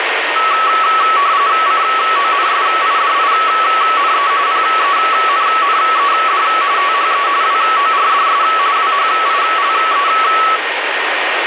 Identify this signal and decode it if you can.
RTTY (45.45 baud, 170 Hz shift), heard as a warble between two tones, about 1220 Hz centre, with radio static and a steady whistle near 1850 Hz. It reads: CONSIDINE PENNED THE WORDS WHILE